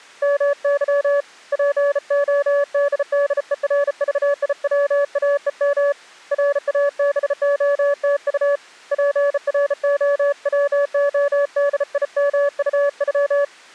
Morse code (Russian alphabet), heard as a keyed tone, hand-sent with a bug key, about 34 wpm, 570 Hz. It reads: МЫ ПОДДЕРЖИВАЕМ РАБОТУ ПРОВОДИМУЮ